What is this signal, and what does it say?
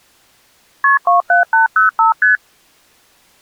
Multi-frequency trunk signalling (R1, as on North American trunks), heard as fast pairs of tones, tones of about 130 ms. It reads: KP 27805 ST